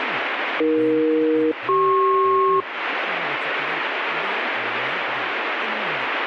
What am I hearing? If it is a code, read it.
Aircraft SELCAL, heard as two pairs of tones, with radio static and speech in Manipuri. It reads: AE-CP